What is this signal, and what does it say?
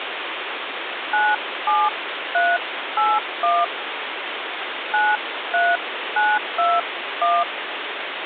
DTMF, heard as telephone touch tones, dialled by hand, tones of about 220 ms, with phone line noise. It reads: 97381 93921